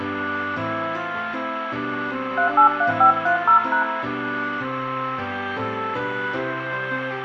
DTMF, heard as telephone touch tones, dialled by hand, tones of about 100 ms, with radio hiss and room echo. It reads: 383530#